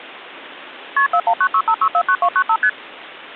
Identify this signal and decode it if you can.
Multi-frequency trunk signalling (R1, as on North American trunks), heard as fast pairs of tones, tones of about 70 ms. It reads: KP 41965649295 ST